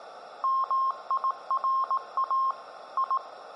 Morse code (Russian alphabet), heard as a keyed tone, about 18 wpm, 1060 Hz. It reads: МИРА И